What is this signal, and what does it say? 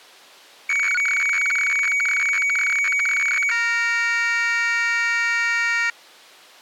Weather fax (radiofax), 120 lines a minute, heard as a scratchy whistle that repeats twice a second.